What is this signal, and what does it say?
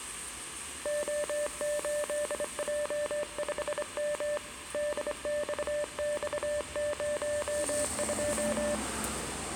Morse code, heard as a keyed tone, hand-sent with a straight key, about 26 wpm, 590 Hz, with room echo and street noise. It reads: O8J5M DXX02